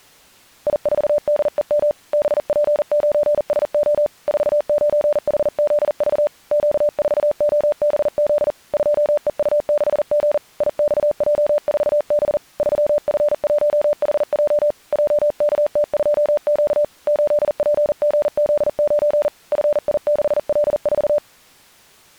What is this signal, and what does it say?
Morse code, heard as a keyed tone, hand-sent with a paddle, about 40 wpm, 590 Hz. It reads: I4DEM BP9SO 49HZV Q4OBZ 2EU6G IXJ4B 3F1HJ JKT2Q 8PGZ9 FI6L4